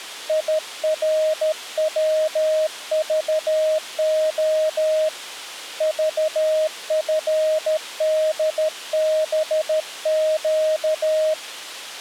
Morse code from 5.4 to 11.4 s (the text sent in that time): VFDBQ